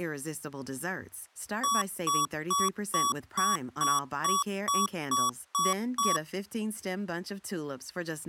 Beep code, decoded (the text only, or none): 11 short